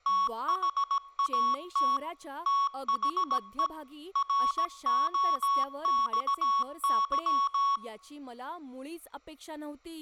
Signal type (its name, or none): Morse code